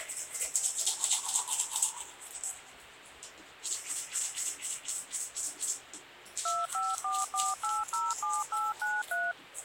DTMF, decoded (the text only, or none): 2544807893